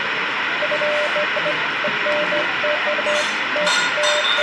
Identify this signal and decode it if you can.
Beeps of irregular length, with radio hiss, room echo and the noise of a restaurant. There is no code.